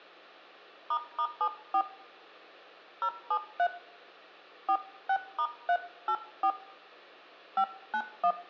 DTMF, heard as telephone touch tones, dialled by hand, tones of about 70 ms, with hum and room echo. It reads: **74 073 46*384 591